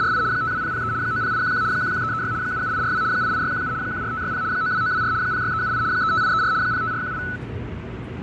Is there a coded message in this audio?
Yes: RTTY (75 baud, 170 Hz shift) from 0.0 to 7.4 s, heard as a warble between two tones, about 1400 Hz centre, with radio static, fading and the noise inside a subway train. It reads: … 52003 90811 11336 77842 88617 14560 92924 06378 35834 05418